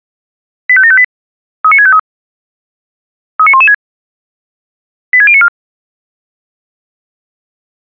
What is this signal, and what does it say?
Five-tone selective call (ZVEI), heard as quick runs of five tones, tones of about 70 ms. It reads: 85758 39653 39116 86094